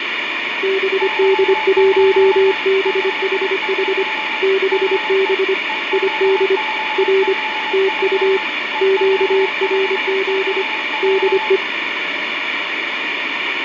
Morse code, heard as two keyed tones, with radio static, fading and room echo. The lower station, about 25 wpm, 390 Hz: BD1BHH 6B ID R TU QRZ DE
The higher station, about 22 wpm, 870 Hz: CQ CQ DE EB5BW EB5BW